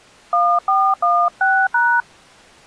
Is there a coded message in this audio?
Yes: DTMF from 0.3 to 2.0 s, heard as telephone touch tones, dialled by hand, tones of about 260 ms. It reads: 1416#